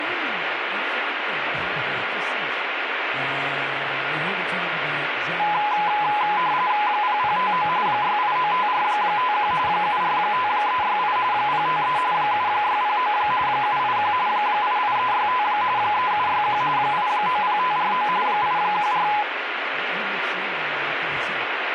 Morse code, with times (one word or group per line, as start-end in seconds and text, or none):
none